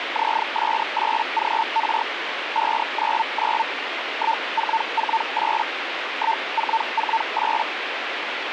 Hellschreiber (Feld-Hell, 122.5 baud), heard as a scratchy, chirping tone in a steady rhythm, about 900 Hz, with radio static. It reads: ZS8GR 599 1448 1448